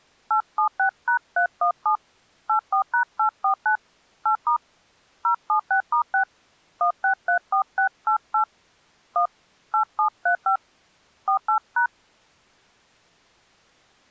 DTMF, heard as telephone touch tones, dialled by hand, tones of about 100 ms. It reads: 876#317 84#849 8* 076*6 1634688 1 8735 48#